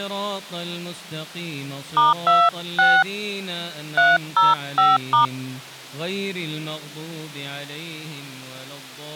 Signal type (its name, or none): DTMF